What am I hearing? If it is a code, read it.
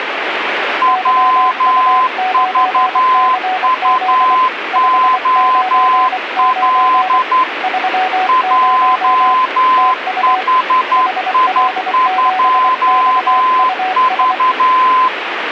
Morse code, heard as two keyed tones, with radio static. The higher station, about 11 wpm, 1030 Hz: WVUOL JHI2V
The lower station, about 24 wpm, 750 Hz: YU9CZ 599 30 TU HL7XUS